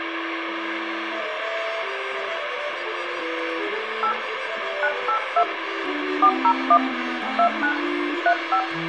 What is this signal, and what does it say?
DTMF, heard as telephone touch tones, dialled by hand, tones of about 80 ms, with phone line noise. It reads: 8 982 401 29 35